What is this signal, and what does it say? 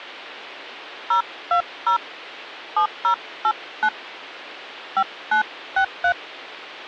DTMF, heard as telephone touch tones, dialled by hand, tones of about 90 ms. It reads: 020 7089 5963